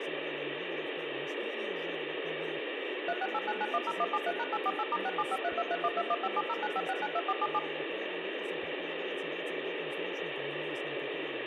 DTMF, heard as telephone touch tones, dialled by machine, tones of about 50 ms, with phone line noise. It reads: 3689910173#848*67532312157095692477